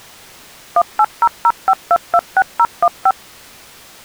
DTMF, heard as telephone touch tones, dialled by machine, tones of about 50 ms. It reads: 18005226015